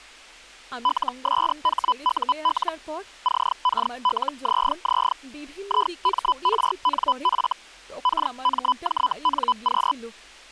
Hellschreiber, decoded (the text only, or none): LSHUL CKLZZ IMRNF KMJNQ